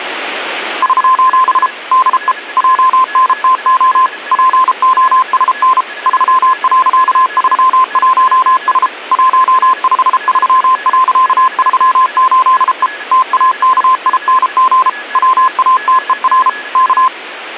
Morse code, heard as a keyed tone, machine-sent, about 33 wpm, 1040 Hz, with a weaker station near 1690 Hz. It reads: <SOS> DE JNTO POSN 3.31S 153.38E TAKING WATER K